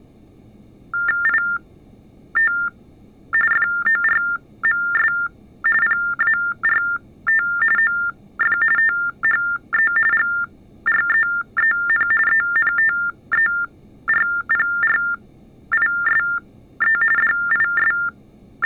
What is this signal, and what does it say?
TTY/TDD text telephone tones (45.45 baud Baudot), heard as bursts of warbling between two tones, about 400 Hz shift, 1600 Hz centre. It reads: IT FORMS PART OF THE GREEN ENTERPRISE …